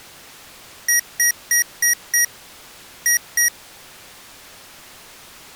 Beep code, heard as beeps from a small speaker, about 1900 Hz. 5-2.